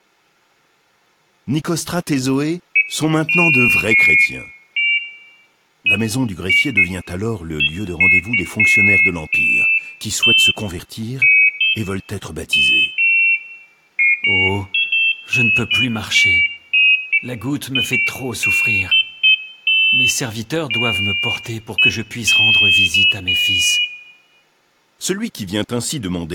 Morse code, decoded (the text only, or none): none